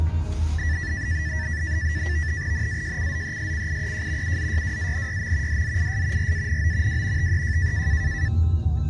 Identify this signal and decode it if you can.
NAVTEX (SITOR-B), 100 baud, 170 Hz shift, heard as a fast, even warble, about 1850 Hz centre, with the noise inside a car. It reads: NAJCZESCIEJ UZYWANYM DZIS RANO W TEJ